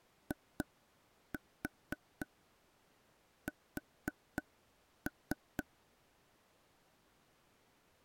Tap code, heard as taps on a table, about 4 knocks a second. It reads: IS